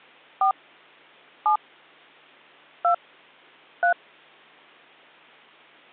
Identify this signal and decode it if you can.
DTMF, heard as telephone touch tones, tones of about 100 ms. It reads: 4 7 2 3